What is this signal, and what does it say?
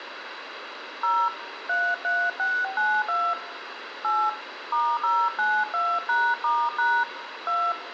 DTMF, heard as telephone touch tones, dialled by hand, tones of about 250 ms, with phone line noise and room echo. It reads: 0 33692 8 *092#*# 2